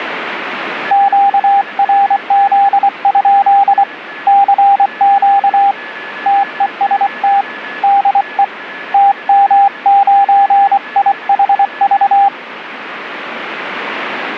Morse code, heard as a keyed tone, hand-sent with a paddle, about 24 wpm, 800 Hz, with radio static and a weaker station near 1720 Hz. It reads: QRZ? CQ TEST DE TM9IHV